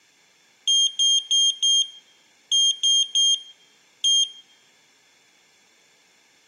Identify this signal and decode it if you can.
Beep code, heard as a piezo beeper, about 3200 Hz, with room echo. 4-3-1. In Phoenix BIOS tables: memory failure above the first 64 KB.